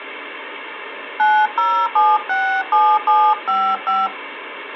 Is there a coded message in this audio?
Yes: DTMF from 1.2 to 4.1 s, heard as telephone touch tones, dialled by hand, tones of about 280 ms, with phone line noise. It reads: 90767755